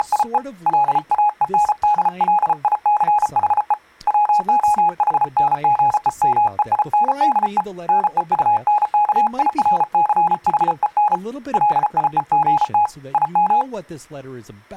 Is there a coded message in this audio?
Yes: Morse code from 0.0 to 13.7 s, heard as a keyed tone, hand-sent with a paddle, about 34 wpm, 840 Hz. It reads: … LAENDLICHE WOHNGEMEINDE NEUNKIRCHEN LIEGT IM